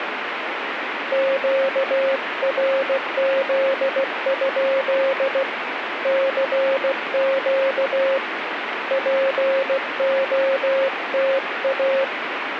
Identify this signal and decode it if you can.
Morse code, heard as a keyed tone, hand-sent with a paddle, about 16 wpm, 540 Hz, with radio static. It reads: QRZ? CQ POTA